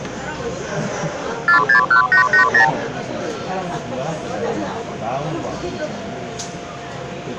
Multi-frequency trunk signalling (R2, with the far end's replies), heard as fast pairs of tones, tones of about 110 ms, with hum and the noise inside a subway train. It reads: 461880